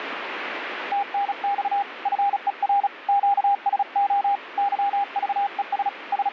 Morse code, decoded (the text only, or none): TNX FER QSO YVES …